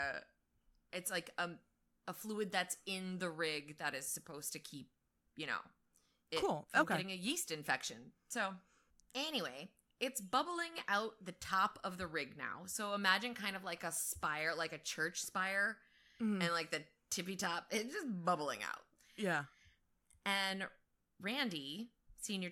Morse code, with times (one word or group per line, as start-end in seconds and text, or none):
none